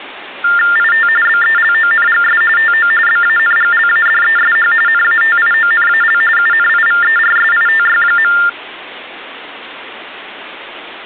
TTY/TDD text telephone tones (45.45 baud Baudot), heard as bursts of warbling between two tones, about 400 Hz shift, 1600 Hz centre. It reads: IT BELONGS TO BANGLADESH NATIONAL UNIVERSITY.